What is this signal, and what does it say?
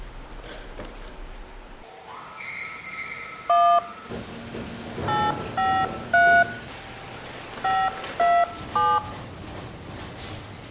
DTMF, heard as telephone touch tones, dialled by hand, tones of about 240 ms. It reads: 1 853 527